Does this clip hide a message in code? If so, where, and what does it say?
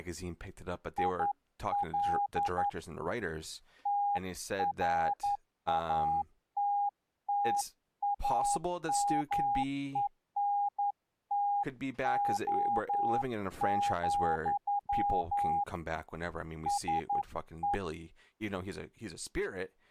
Yes: Morse code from 0.9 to 17.8 s, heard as a keyed tone, hand-sent with a paddle, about 11 wpm, 810 Hz, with speech in English. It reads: IL TRATTAMENTO, SE